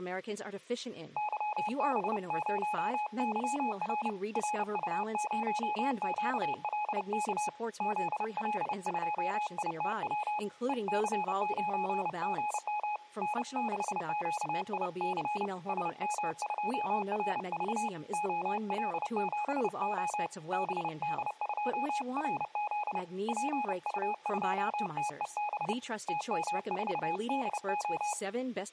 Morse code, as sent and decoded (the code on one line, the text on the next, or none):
-.-- -... ----- -.-- .-. / .-. ..- ----- --.- .-.. -.- / --.. .-.. ..--- .. - .-- / . -.-. ----. --. -- / -. -.... --.- .. -.-. / ... -- ..--- .-. ...- / --- .-.. --... --- / -... -.. ..--- .-. --.. / .--. ..- ..--- - . -... / - -- ....- -.. ---
YB0YR RU0QLK ZL2ITW EC9GM N6QIC SM2RV OL7O BD2RZ PU2TEB TM4DO